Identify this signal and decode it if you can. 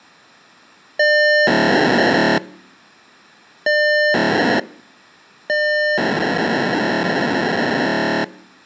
POCSAG pager data (1200 baud), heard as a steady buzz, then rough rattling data.